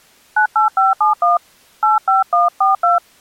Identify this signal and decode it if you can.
DTMF, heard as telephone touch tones, dialled by hand, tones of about 130 ms. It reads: 98571 85142